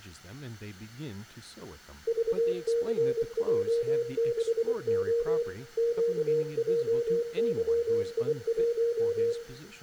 Morse code, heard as a keyed tone, machine-sent, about 24 wpm, 470 Hz, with room echo and speech in English. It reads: VCJ6O QJYI1